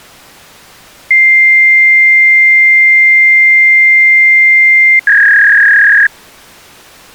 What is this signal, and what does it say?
Fax machine handshake, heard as a long tone and a warble.